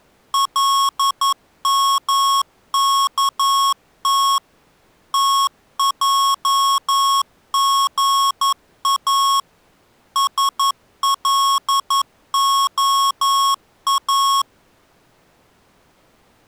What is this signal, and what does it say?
Morse code (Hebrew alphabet), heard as electronic beeps, machine-sent, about 11 wpm, 1100 Hz. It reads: למכת תעגא שלהא